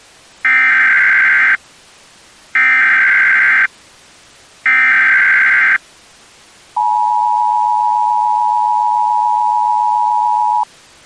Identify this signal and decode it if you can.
Emergency Alert System (SAME) tones (header bursts, then the 853 and 960 Hz attention tone), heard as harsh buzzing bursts, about 520.83 baud.